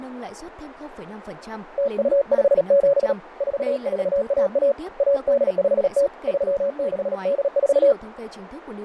Morse code (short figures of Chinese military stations), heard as a keyed tone, hand-sent with a paddle, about 37 wpm, 560 Hz, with radio static, fading and speech in Vietnamese. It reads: 0257 4411 1850 3684